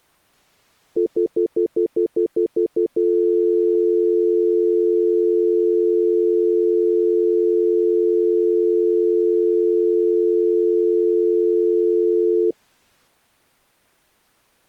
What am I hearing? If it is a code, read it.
Telephone call progress tone (North American plan), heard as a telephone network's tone, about 350, 440 Hz, 0.1 s on and 0.1 s off. Stutter dial tone.